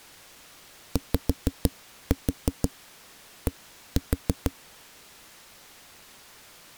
Tap code, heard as knocks on a wall, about 6 knocks a second. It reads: YD